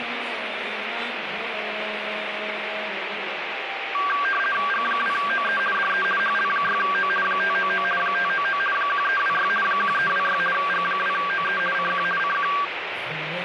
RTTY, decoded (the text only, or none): G2OE DE HL6O 599 599 1326 1326 G2OE CQ CQ